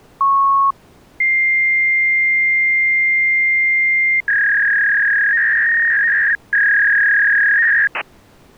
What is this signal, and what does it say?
Fax machine handshake, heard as a beep, a long tone and a warble.